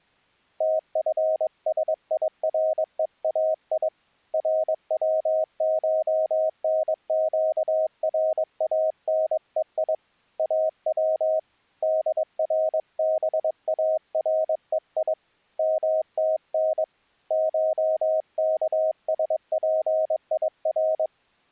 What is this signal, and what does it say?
Morse code (Persian alphabet), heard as a keyed tone, hand-sent with a paddle, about 22 wpm, 630 Hz. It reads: تفسیرهای روشنگرانهی او دربارهی متن شکسپیر